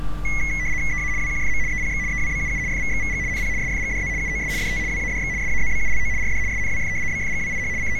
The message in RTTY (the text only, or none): EA WQFM EPX EWBUU FVXVG NP SFGDZ UOS DT WADX SAZBULO RD SNWF BFGWIH …